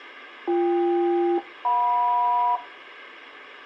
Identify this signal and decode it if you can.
Aircraft SELCAL, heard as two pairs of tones. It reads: BK-JM